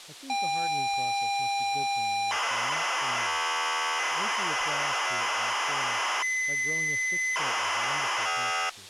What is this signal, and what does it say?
ZX Spectrum tape loading, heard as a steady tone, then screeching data, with speech in English.